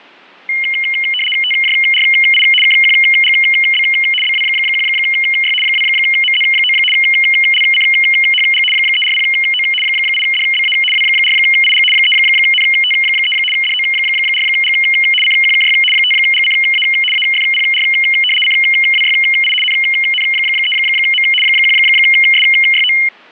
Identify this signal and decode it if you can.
RTTY (75 baud, 850 Hz shift), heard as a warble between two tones, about 2550 Hz centre. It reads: TJRI KQGB BW1Y 2MZ9 LCHG 340O 8DBA W4IG 3NT3 DO4G CQKY 5GCA AFPR CWYI NN3M 1SYO